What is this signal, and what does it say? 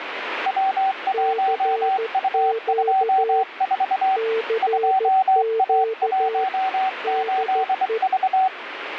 Morse code, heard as two keyed tones, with radio static. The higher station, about 24 wpm, 760 Hz: W1U24 2A18V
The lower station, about 14 wpm, 450 Hz: CQ CQ DE